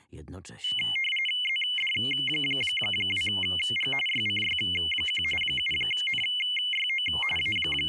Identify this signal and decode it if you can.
RTTY (45.45 baud, 850 Hz shift), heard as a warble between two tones, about 2550 Hz centre. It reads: ZD2G YCY1 7NYO …